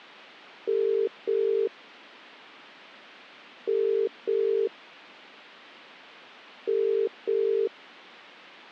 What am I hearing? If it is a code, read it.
Telephone call progress tone (as in the UK, Ireland, Australia and similar networks), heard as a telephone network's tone, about 400, 450 Hz. Ringback tone.